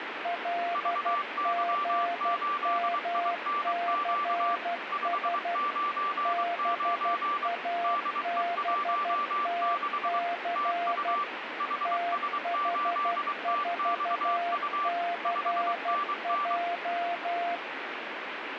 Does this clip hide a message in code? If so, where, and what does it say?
Yes: Morse code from 0.2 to 17.6 s, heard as two keyed tones, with radio static. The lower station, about 12 wpm, 690 Hz: LGMCS BABTC TH4CJ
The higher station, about 23 wpm, 1170 Hz: VY8INQ 599 DE16 TU HS8TXU 5NN